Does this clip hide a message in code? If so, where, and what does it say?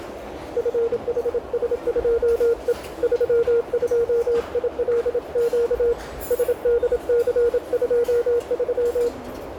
Yes: Morse code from 0.5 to 9.1 s, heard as a keyed tone, hand-sent with a paddle, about 27 wpm, 470 Hz, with radio static, a narrow filter and the noise of a restaurant. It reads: FHS2E 32ILQ SDC23